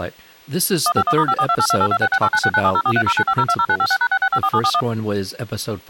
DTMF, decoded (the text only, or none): 151*54282826689697043095020956#6654741